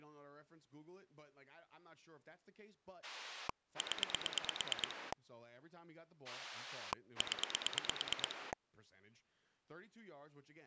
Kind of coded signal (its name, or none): pulse dialling